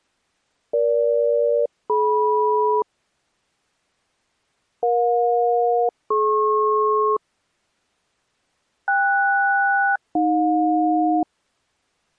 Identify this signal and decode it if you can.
Aircraft SELCAL, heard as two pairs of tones. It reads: EG-DM EJ-DP KS-AJ